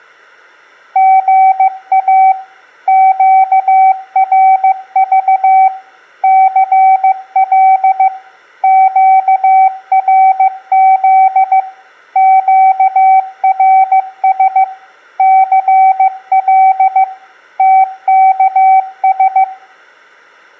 Morse code, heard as a keyed tone, machine-sent, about 15 wpm, 760 Hz, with room echo. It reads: GA QRV CL QRZ QRS CL TKS